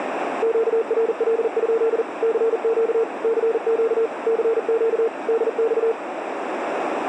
Morse code, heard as a keyed tone, machine-sent, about 40 wpm, 450 Hz, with radio static and a narrow filter. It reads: QRL? CQ CQ CQ DX